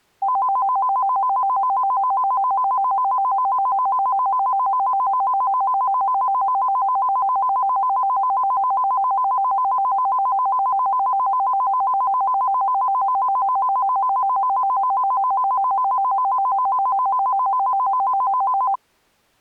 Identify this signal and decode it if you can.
A tone that alternates evenly between two pitches. There is no code.